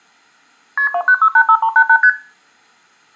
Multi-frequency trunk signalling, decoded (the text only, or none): KP 29685388 ST